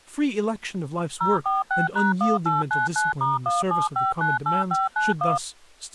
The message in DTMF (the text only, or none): 046#1899*17598591